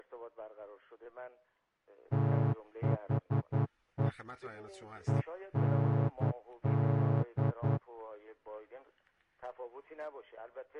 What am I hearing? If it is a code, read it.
Morse code, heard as a horn, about 10 wpm. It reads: THE END